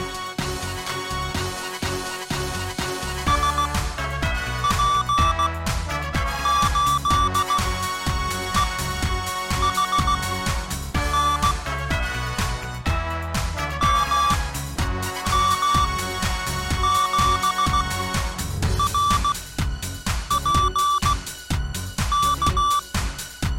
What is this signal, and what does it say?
Morse code, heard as electronic beeps, machine-sent, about 16 wpm, spaced as for 7 wpm, 1160 Hz. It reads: SP8EHN MM7RPK